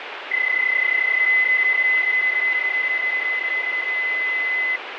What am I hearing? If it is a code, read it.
PSK31 (31.25 baud), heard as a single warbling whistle, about 2050 Hz, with radio static.